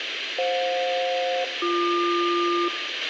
Aircraft SELCAL, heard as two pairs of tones, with radio hiss, a squelch burst at the end and room echo. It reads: FJ-BQ